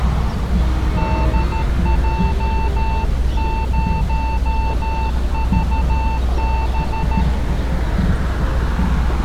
Morse code, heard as a keyed tone, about 13 wpm, 890 Hz, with street noise. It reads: DJ0VB